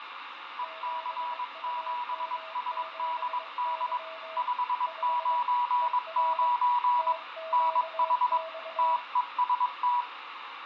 Morse code, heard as two keyed tones, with radio static and fading. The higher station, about 22 wpm, 980 Hz: EC7SDD 599 NH TEST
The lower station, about 22 wpm, 650 Hz: 7UM7Y 5 ER TQX